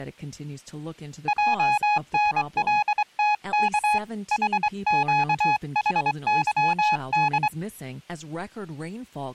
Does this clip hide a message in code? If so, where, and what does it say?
Yes: Morse code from 1.2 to 7.5 s, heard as a keyed tone, hand-sent with a straight key, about 24 wpm, 840 Hz, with speech in English. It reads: JNLTK HQHYD